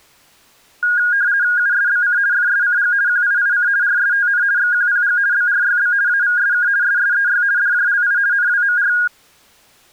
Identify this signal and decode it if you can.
RTTY (50 baud, 170 Hz shift), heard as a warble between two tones, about 1550 Hz centre. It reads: USBC FSCG QIIC RSTN XQPG BRYB AVSK SSEY DJLI NWMR